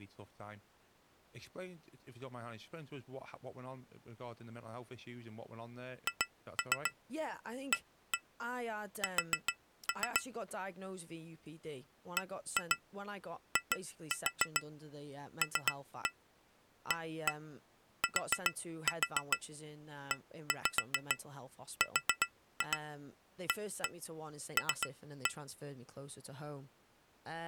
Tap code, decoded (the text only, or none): HAS BILATERAL